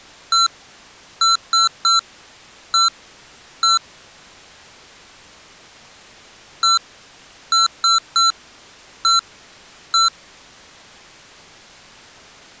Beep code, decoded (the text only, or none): 1-3-1-1